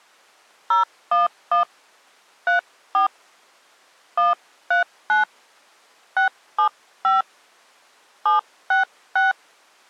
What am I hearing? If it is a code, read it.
DTMF, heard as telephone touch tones, dialled by hand, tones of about 120 ms. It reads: 011 34 139 675 766